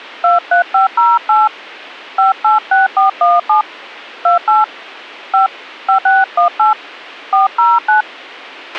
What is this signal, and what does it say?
DTMF, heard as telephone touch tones, dialled by hand, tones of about 140 ms, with a squelch burst at the end. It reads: 23508 586417 28 5 5618 409